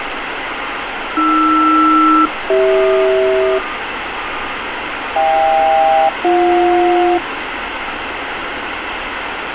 Aircraft SELCAL, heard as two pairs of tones, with radio static and street noise. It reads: AR-CH HK-BJ